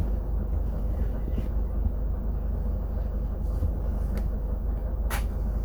The noise inside a bus. There is no code.